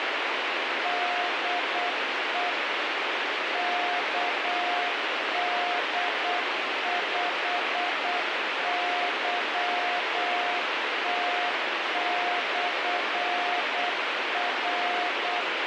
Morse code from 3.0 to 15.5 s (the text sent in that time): KD5YT/R